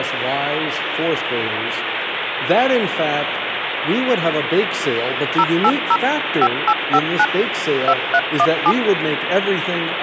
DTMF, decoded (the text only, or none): 080 5859 2317